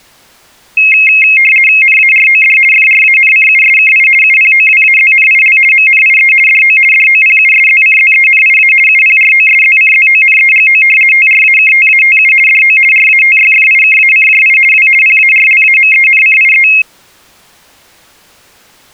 RTTY (50 baud, 450 Hz shift), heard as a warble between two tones, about 2350 Hz centre. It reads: NAROD FRANCUSKI UPOWAZNIL MNIE DO DOPUSZCZENIA UPROSZCZONEGO TRAKTATU DO RATYFIKACJI W PARLAMENCIE